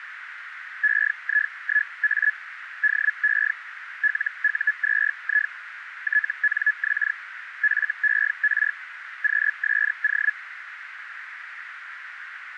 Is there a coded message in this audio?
Yes: Hellschreiber (Feld-Hell, 122.5 baud) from 0.8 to 10.3 s, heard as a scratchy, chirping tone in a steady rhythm, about 1700 Hz, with radio static and a narrow filter. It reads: EI1A DE LU2I TNX FER QSO